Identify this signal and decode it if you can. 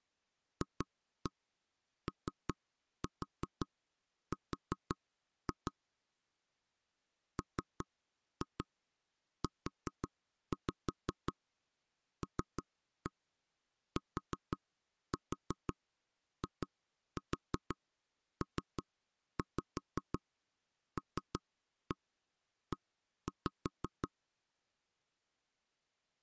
Tap code, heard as knocks on wood, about 5 knocks a second. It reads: FOR MULTIPLE